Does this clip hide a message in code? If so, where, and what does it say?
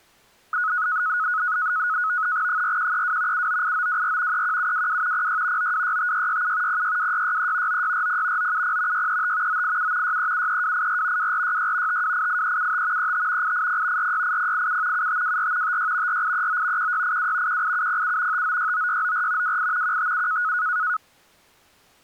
Yes: NAVTEX (SITOR-B), 100 baud, 170 Hz shift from 0.5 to 21.0 s, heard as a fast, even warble, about 1370 Hz centre. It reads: 4132 798924 31722 06 9265667 062663 9640 970 635 987 6373284 2466 5288375 35 880 468087 7524 56 4839 1682 18707 5969694 28 157